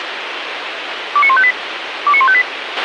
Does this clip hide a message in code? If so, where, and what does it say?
Yes: five-tone selective call (ZVEI) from 1.2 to 2.4 s, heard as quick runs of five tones, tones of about 70 ms, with radio hiss and a squelch burst at the end. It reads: 29158 29158